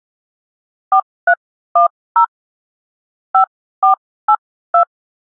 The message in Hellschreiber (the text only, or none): none